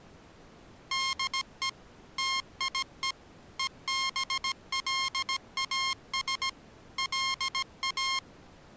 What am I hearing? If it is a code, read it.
Morse code, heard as electronic beeps, machine-sent, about 17 wpm, 1070 Hz. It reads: DE TIE EBLAS LA